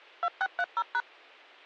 DTMF, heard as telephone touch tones, dialled by machine, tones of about 50 ms. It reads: 2630#